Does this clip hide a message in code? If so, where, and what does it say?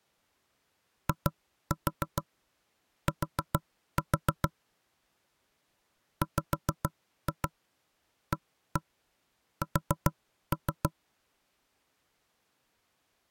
Yes: tap code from 1.1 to 10.9 s, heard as knocks on wood, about 6 knocks a second. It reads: IT WAS